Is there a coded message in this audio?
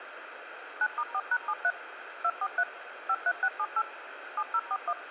Yes: DTMF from 0.8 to 4.9 s, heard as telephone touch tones, dialled by machine, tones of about 60 ms, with radio hiss. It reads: 9*4#73 243 53678 7041